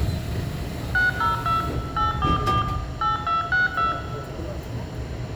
DTMF, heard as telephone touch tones, dialled by machine, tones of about 150 ms, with room echo and the noise inside a subway train. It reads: 602 844 8262